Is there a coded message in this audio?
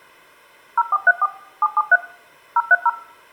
Yes: DTMF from 0.8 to 2.9 s, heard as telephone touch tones, dialled by machine, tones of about 40 ms. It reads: 0434 773 030